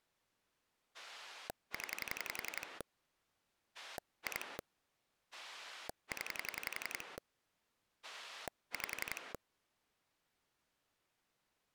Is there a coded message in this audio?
Yes: pulse dialling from 0.9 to 9.4 s, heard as a rotary dial, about 11 pulses a second. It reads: 0 2 0 5